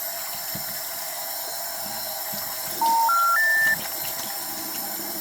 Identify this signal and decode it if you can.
Telephone call progress tone (North American plan), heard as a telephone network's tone, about 910, 1370, 1800 Hz, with the noise of a restroom. Special information tone.